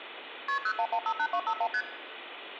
Multi-frequency trunk signalling (R1, as on North American trunks), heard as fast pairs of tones, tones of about 70 ms, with phone line noise and room echo. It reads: KP 01158251 ST